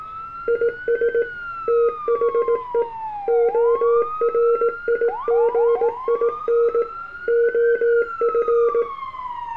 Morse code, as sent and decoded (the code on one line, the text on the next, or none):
.. ... / - .... . / --- .-. .. --. .. -. / --- ..-.
IS THE ORIGIN OF